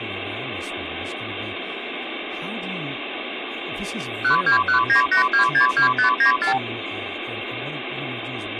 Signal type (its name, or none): multi-frequency trunk signalling